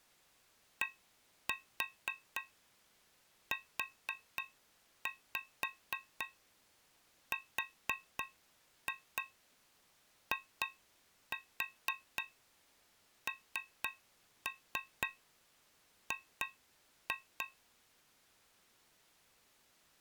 Tap code, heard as taps on a metal pipe, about 4 knocks a second. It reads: DURING